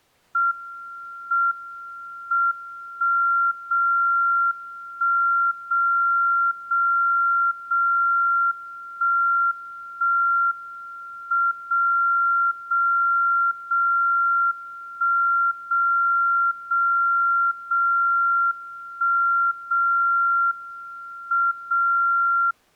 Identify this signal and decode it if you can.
Radio time signal (WWVB), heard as a tone whose level steps once a second, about 1380 Hz. The time is 12:53 UTC. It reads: M M 1 0 1 0 0 0 1 1 M 0 0 0 1 0 0 0 1 0 M 0